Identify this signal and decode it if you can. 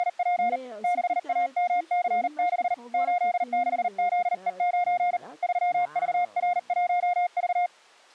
Morse code, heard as a keyed tone, hand-sent with a paddle, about 39 wpm, 710 Hz, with speech in French. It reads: … 6AMC6 86ZE9 3VR1V